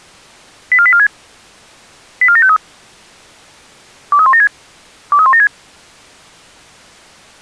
Five-tone selective call (ZVEI), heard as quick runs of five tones, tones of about 70 ms. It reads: 84846 84753 23176 23176